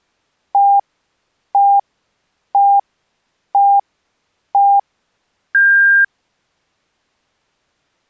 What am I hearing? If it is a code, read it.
Radio time signal (five pips and a higher one, as on Chinese radio), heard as pips.